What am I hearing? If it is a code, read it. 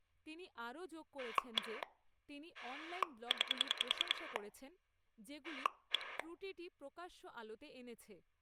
Pulse dialling, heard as a rotary dial, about 10 pulses a second, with speech in Bangla. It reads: 1 9 1